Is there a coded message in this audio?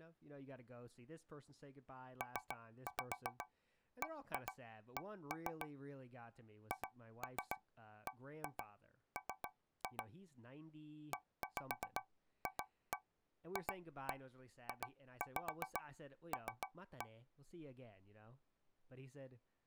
Yes: tap code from 2.2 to 17.2 s, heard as taps on a metal pipe, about 7 knocks a second, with speech in English. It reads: PBC HBM EFFJL